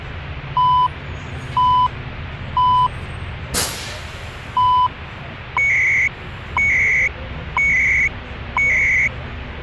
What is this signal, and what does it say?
Radio time signal (CHU, Canada), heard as beeps and data bursts, one a second, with radio static and the noise inside a bus.